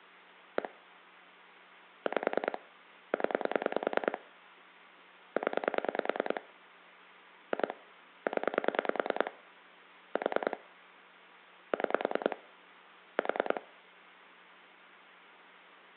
Pulse dialling, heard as clicks on a phone line, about 10 pulses a second. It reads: 1 5 0 0 2 0 4 6 4